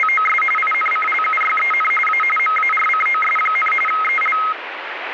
RTTY (45.45 baud, 850 Hz shift), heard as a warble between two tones, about 1700 Hz centre, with radio static. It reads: … INCLUYEN A MARCOS, EL